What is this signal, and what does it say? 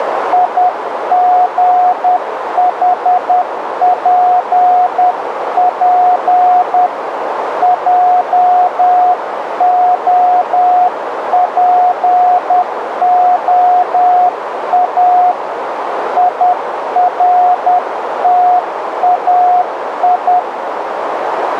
Morse code, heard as a keyed tone, hand-sent with a paddle, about 10 wpm, 720 Hz, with radio static and a narrow filter. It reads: IGHPP JOPOA IRTAI